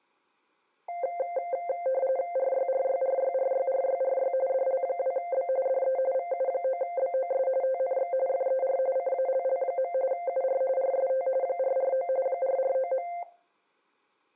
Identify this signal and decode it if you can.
RTTY (45.45 baud, 170 Hz shift), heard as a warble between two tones, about 610 Hz centre, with room echo. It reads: RYRYRYRYRYRY DL2B DE VU9BOS TNX FER CALL. UR RST 449 449.